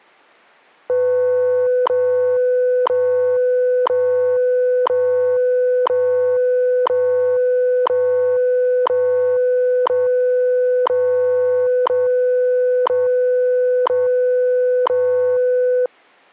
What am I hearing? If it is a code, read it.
Radio time signal (WWV, Colorado), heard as ticks, one a second.